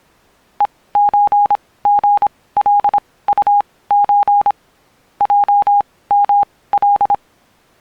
Morse code (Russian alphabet), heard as a keyed tone, machine-sent, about 26 wpm, spaced as for 18 wpm, 820 Hz. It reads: ЕЧГЛУЧ ЙМЛ